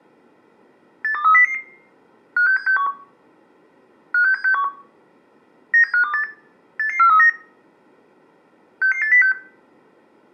Five-tone selective call (CCIR), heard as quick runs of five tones, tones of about 100 ms, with room echo. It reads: 82300 56761 56761 97528 88439 66806